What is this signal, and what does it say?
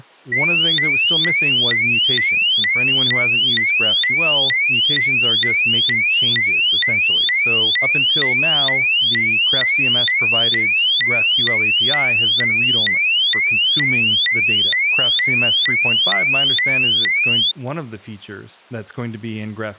A tone that sweeps in pitch again and again, with speech in English. There is no code.